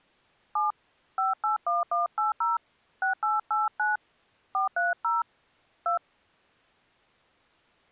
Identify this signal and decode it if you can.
DTMF, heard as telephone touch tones, dialled by hand, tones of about 140 ms. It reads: 7 581180 6889 430 2